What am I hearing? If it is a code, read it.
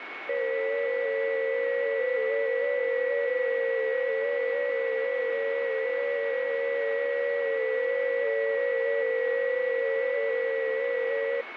FT8 (several signals at once), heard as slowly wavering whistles, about 6.25 baud, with radio static and a steady whistle near 2210 Hz.